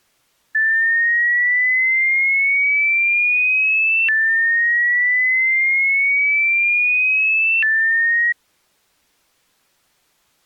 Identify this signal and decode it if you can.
A tone that sweeps in pitch again and again. There is no code.